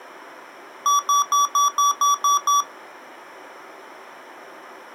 Beep code, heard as beeps from a small speaker, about 1150 Hz. 8 short. In AMI BIOS tables: display memory failure; in Dell tables: LCD failure.